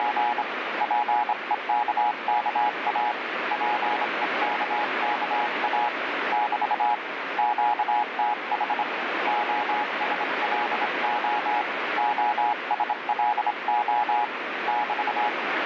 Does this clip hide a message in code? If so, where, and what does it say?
Yes: Morse code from 0.0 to 15.4 s, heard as a keyed tone, hand-sent with a straight key, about 26 wpm, 840 Hz, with heavy radio static. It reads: … PEKKA PEKKA <BT> QTH OSLO OSLO <BT>